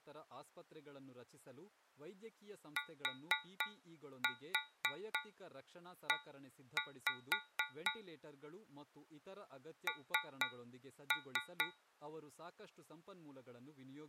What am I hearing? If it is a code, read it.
Tap code, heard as taps on a metal pipe, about 4 knocks a second, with speech in Kannada. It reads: TE N